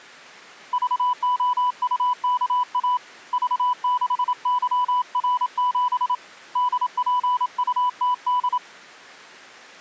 Morse code, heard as a keyed tone, hand-sent with a paddle, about 27 wpm, 990 Hz. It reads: VOUKA V6YR7 DPUTD